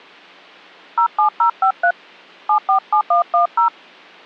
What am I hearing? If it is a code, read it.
DTMF, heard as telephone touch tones, dialled by hand, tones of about 100 ms. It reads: 07053 747110